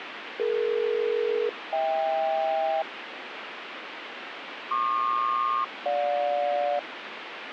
Aircraft SELCAL, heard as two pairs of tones, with radio static. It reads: DE-HK PQ-GJ